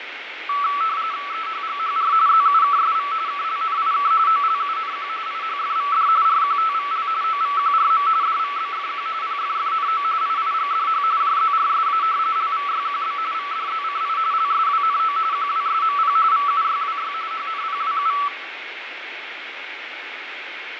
RTTY (45.45 baud, 170 Hz shift), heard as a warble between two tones, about 1230 Hz centre, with radio static, fading and room echo. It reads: EHGHR ZUKSV KLNIK OLUNQ IHFVD RQTVL OVQRM DVBFQ PFFNO IIGDH JZRSA LVYQB VDZCI LSWNO QWSMP VUYWY HNPWU